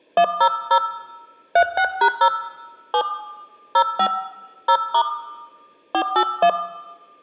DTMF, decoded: 100 36#0 7 05 0* 481

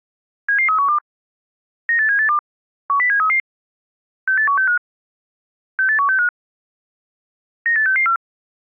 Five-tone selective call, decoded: 77312 98782 10733 68165 68165 98664

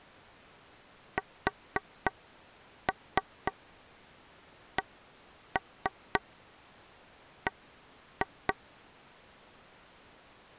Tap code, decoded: SCB

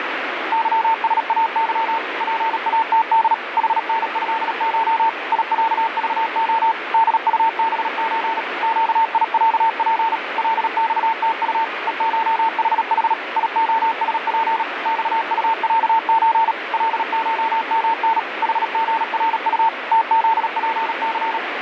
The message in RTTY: none

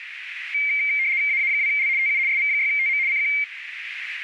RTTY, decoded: AA2L TU SV6TM CQ

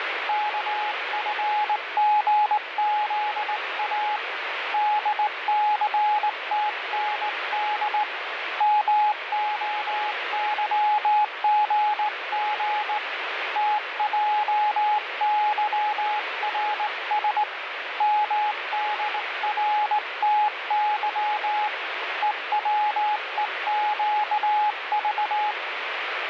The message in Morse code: KFGZA DCTND MOYGG TJYRS MDRTY EWEQV

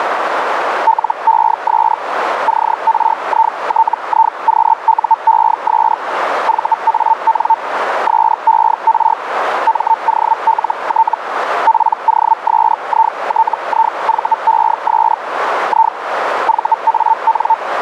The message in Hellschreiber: LES CRITIQUES VAN SER MOLT POSITIVES I VAN

